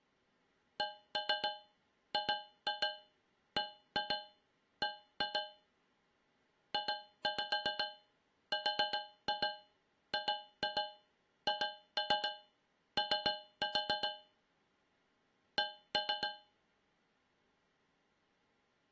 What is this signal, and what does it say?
Tap code, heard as taps on a metal pipe, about 7 knocks a second. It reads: CGBB JRGHO C